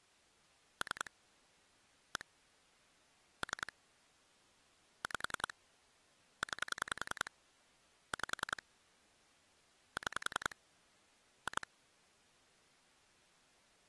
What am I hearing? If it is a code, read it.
Pulse dialling, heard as clicks on a phone line, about 10 pulses a second. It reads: 3 1 3 5 9 5 6 2